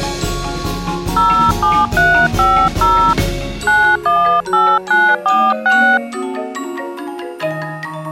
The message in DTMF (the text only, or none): 07350 918946